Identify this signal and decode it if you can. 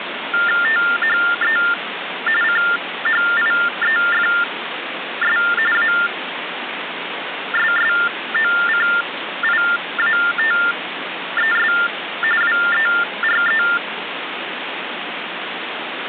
TTY/TDD text telephone tones (45.45 baud Baudot), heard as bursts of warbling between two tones, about 400 Hz shift, 1600 Hz centre, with phone line noise. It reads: THE CHIEFS ASSOCIATES WERE